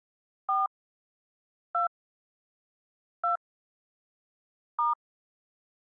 DTMF, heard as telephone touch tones, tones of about 140 ms. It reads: 4 2 2 *